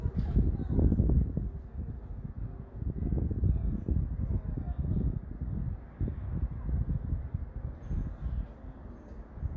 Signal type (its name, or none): none